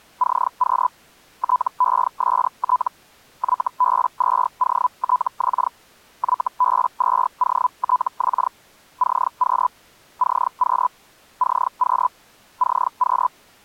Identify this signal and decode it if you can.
Hellschreiber (Feld-Hell, 122.5 baud), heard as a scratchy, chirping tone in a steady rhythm, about 1000 Hz. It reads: CQ TEST YB2OTX YB2OTX CQ CQ CQ CQ